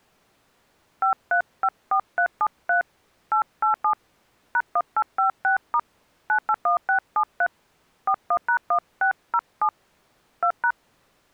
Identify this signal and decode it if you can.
DTMF, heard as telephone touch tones, dialled by hand, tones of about 90 ms. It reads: 5354373 887 #1856* 981673 41#1607 2#